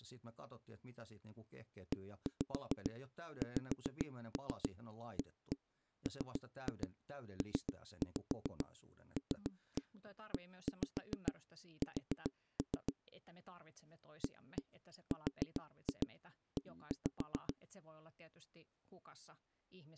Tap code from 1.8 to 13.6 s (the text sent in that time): EXAMPLES